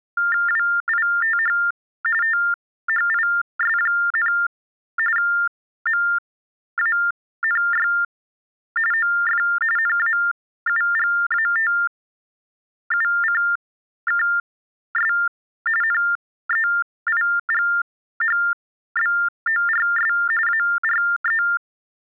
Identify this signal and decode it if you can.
TTY/TDD text telephone tones (45.45 baud Baudot), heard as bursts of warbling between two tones, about 400 Hz shift, 1600 Hz centre. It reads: WITH THIS, MANY OF NAUGATUCKS NEIGHBORS ARE